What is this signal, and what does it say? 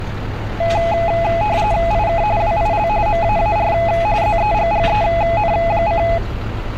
RTTY (45.45 baud, 170 Hz shift), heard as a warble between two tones, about 760 Hz centre, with street noise. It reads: IK WIL MAAR ZEGGEN: